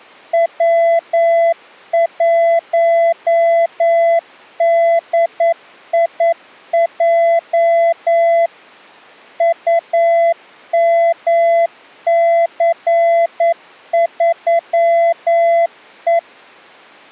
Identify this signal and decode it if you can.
Morse code, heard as a keyed tone, machine-sent, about 9 wpm, 670 Hz. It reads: W1DIJ UMC3E